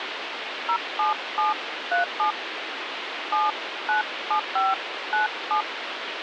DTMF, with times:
0.7-2.3 07737
3.3-5.6 797597

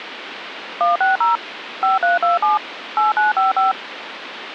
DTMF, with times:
0.8-1.4 160
1.8-2.6 5327
3.0-3.7 8955

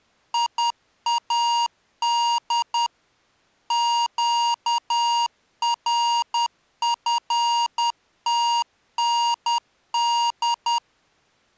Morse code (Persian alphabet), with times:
0.3-2.9 یاد
3.7-10.8 گرفتند

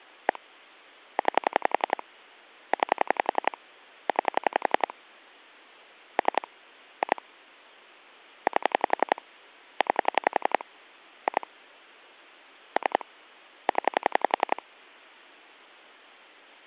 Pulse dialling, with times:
0.3-0.4 1
1.2-2.0 9
2.7-3.6 9
4.1-4.9 9
6.2-6.5 3
7.0-7.2 2
8.5-9.2 8
9.8-10.6 9
11.3-11.5 2
12.8-13.0 3
13.7-14.6 0

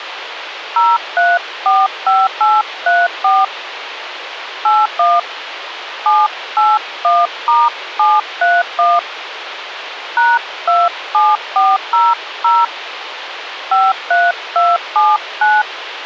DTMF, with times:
0.8-3.4 0345834
4.6-5.2 81
6.1-9.0 781*731
10.2-12.6 #27400
13.7-15.6 53279

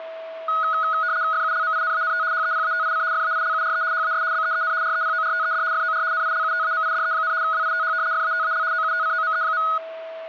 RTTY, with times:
1.3-2.2 FULMINANT
2.3-3.0 HEPATIC
3.1-3.8 FAILURE
3.9-4.2 HAS
4.3-4.7 BEEN
4.8-5.6 REPORTED
5.7-6.0 FOR
6.1-7.3 NILUTAMIDE,
7.4-7.9 WITH
8.1-8.6 FATAL
8.7-9.6 OUTCOME.

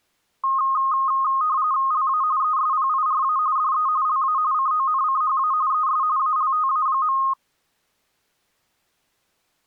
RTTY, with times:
1.9-2.2 LA
2.4-3.4 ESPIRA
3.6-3.9 DE
4.1-4.4 LA
4.5-5.5 CONCHA
5.7-6.0 ES
6.2-7.2 ALTA.

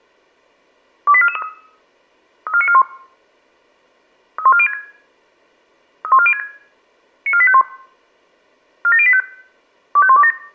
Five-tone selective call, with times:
1.1-1.4 28443
2.5-2.8 34941
4.4-4.7 31406
6.0-6.4 31406
7.3-7.6 94851
8.8-9.2 47085
10.0-10.3 25127

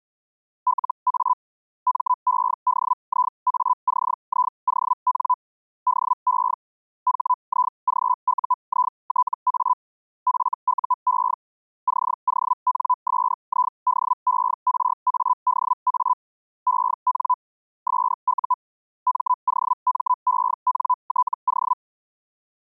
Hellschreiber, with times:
0.7-1.3 LA
1.9-5.3 MEDIACION
5.9-6.5 DE
7.1-9.7 HIGUITA
10.3-11.3 FUE
11.9-16.1 CONSIDERADA
16.7-17.3 EN
17.9-18.5 SU
19.1-21.7 MOMENTO

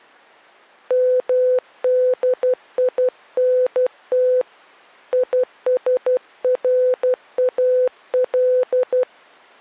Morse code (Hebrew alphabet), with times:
0.9-4.4 מדינת
5.1-9.0 ישראל

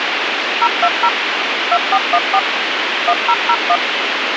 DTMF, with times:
0.6-1.1 020
1.7-2.4 2414
3.1-3.8 1001

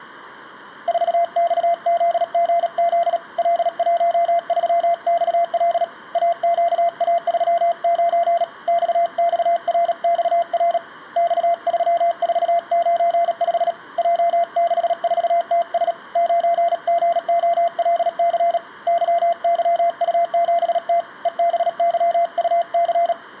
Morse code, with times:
0.9-3.2 4XZGZ
3.4-5.8 L13XL
6.1-8.4 AQA39
8.7-10.8 XXRXR
11.2-13.7 X3495
14.0-15.9 J64TS
16.2-18.6 9GOLC
18.9-21.0 YYU7T
21.3-23.1 EBYUC

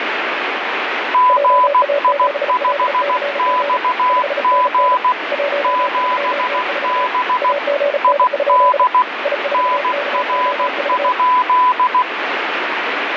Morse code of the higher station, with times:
1.1-5.1 GI5XG
5.6-7.5 7B
8.0-9.0 ID
9.5-12.0 NR?

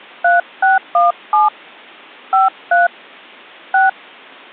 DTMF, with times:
0.2-1.5 3617
2.3-2.9 53
3.7-3.9 6

